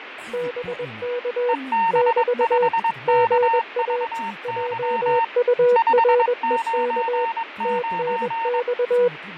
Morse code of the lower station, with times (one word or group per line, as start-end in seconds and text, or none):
0.3-1.5 BK
1.9-2.7 <BT>
3.1-4.0 GA
4.4-7.2 JUREK
7.6-9.1 TNX